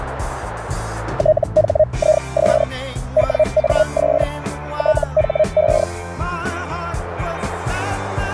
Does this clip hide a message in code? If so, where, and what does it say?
Yes: Hellschreiber (Feld-Hell, 122.5 baud) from 1.2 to 5.8 s, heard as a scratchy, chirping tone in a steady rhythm, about 620 Hz, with radio static. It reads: THIS WAS THE